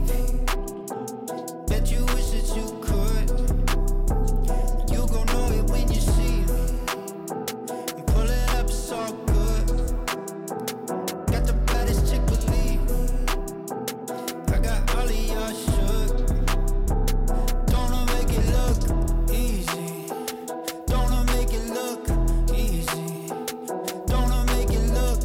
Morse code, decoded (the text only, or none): none